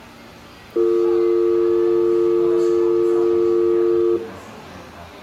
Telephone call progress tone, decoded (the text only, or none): dial tone